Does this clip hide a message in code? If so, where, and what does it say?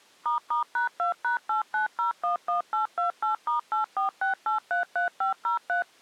Yes: DTMF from 0.3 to 5.8 s, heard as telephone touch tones, dialled by machine, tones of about 120 ms. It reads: **#2#89011828*846833503